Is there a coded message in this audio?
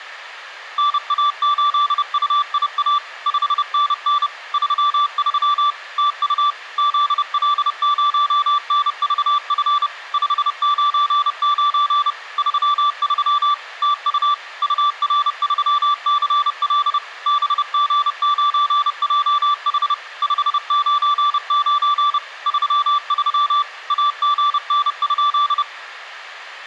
Yes: Morse code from 0.7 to 25.7 s, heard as a keyed tone, machine-sent, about 30 wpm, 1170 Hz. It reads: NA8UIA 5NN 33 TU ZL0NVF 599 33 TU UR3CL BG9JH 599 33 AGN?